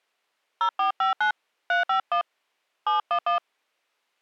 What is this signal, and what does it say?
DTMF, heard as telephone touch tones, dialled by hand, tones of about 120 ms. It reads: 0459 351 711